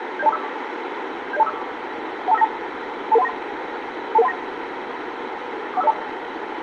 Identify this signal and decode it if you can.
Five-tone selective call (EIA), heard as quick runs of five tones, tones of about 30 ms, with radio hiss and room echo. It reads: 70245 70245 12592 22139 22139 41502